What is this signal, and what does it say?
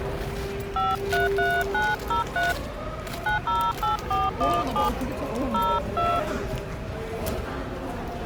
DTMF, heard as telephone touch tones, dialled by hand, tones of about 180 ms, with the noise of a subway station. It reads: 533903 908417 02